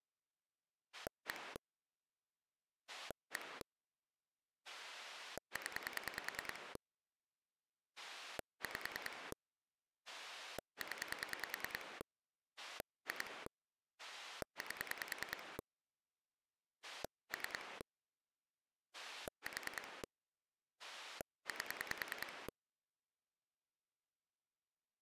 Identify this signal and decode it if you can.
Pulse dialling, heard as a rotary dial, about 10 pulses a second. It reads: 1 1 0 5 0 2 8 3 4 8